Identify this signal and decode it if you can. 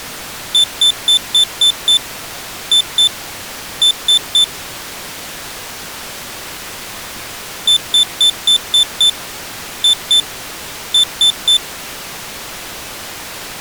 Beep code, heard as a piezo beeper, played twice, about 3550 Hz. 6-2-3.